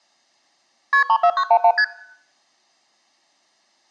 Multi-frequency trunk signalling (R1, as on North American trunks), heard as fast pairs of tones, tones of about 70 ms. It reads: KP 34911 ST